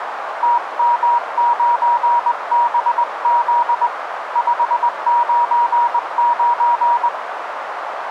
Morse code, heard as a keyed tone, hand-sent with a straight key, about 20 wpm, 950 Hz, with radio static and a narrow filter. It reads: TM9BZ 599